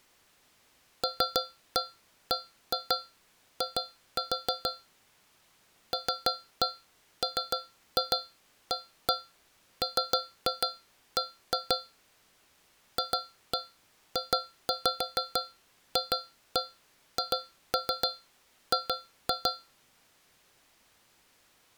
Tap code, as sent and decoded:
3-1 1-2 2-4 / 3-1 3-2 1-1 3-2 1-2 / 2-1 2-5 2-1 2-3 2-2
LBI LMAMB FJFHG

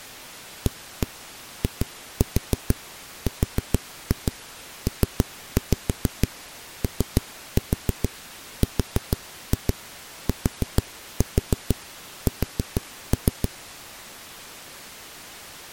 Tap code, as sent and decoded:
1-1 2-4 4-2 3-5 3-4 4-2 4-4 4-3
AIRPORTS

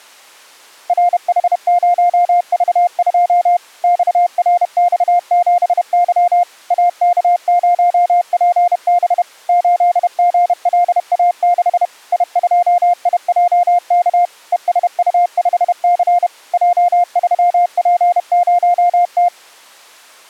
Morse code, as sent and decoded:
.-. .... ----- ...- ..--- / -..- .-. -..- --... -.-- / .- -.- ----- .--. -... / ---.. --. .-.. .- -.... / .. ..--- .. .--- -.- / . ... ..- ..... -.-. / .--- ...-- .--. ----- -
RH0V2 XRX7Y AK0PB 8GLA6 I2IJK ESU5C J3P0T

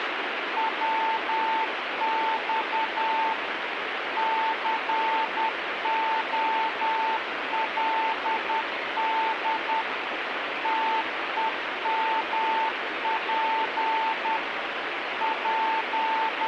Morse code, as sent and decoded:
.-- -..- / -.-. --- .-.. -.. / - . -- .--. / …
WX COLD TEMP …

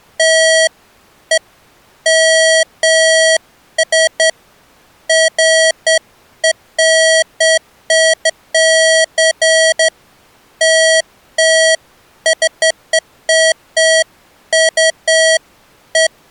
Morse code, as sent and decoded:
none

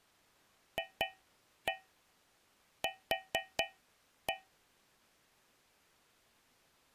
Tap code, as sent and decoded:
2-1 4-1
FQ

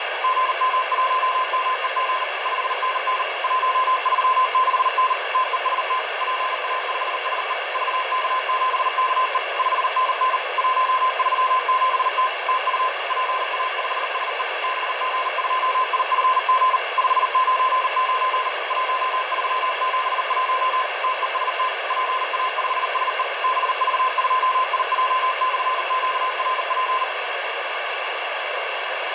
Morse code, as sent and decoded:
--. -- .---- -- . --. / ..... -. -. / .---- ...-- -.... -. / - . ... - / .--. .- ..... ... . / ...- -.- --... -.- . / ..... -. -. / .---- ...-- --... - / - ..- / .--. .- ..... ... . / -... --. ..--- .. ..-. --. / ..... ----. ----. / .---- ...-- --... .---- / - . ... - / .--. .- ..... ... . / -... ...- ..--- .. .--- -..-. --.- .-. .--.
GM1MEG 5NN 136N TEST PA5SE VK7KE 5NN 137T TU PA5SE BG2IFG 599 1371 TEST PA5SE BV2IJ/QRP

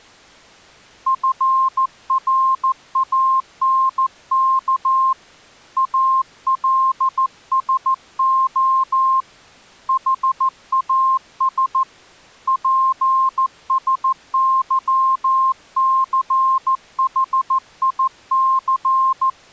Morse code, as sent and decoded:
..-. .-. .- -. -.- / .- .-.. ... --- / .... .- ... / .--. ... -.-- -.-. .... .. -.-.
FRANK ALSO HAS PSYCHIC

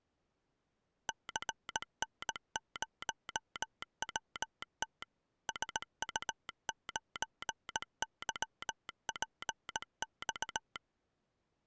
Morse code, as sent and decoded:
-.-. -. ----- .-- - / ... ..- ----. -.-- .--. -..-
CN0WT SU9YPX

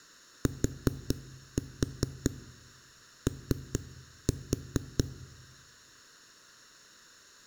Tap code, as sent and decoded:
4-4 3-4
TO

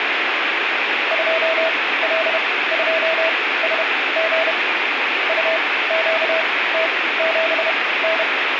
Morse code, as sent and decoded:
..--- .-.. ..--- ... --. / ..- --.- - --... -.
2L2SG UQT7N

